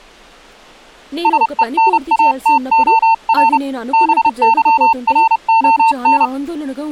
Morse code, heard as a keyed tone, hand-sent with a paddle, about 30 wpm, 900 Hz, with speech in Telugu. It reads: SENATOR BYRON